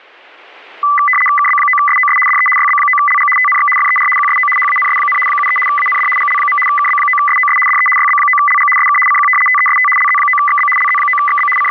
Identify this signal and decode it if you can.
RTTY (75 baud, 850 Hz shift), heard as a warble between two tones, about 1600 Hz centre. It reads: KB9SOS DE YB9LG TNX FER QSO HANS, 73 AND GL. KB9SOS DE YB9LG SK CQ TEST LZ9XB LZ9XB …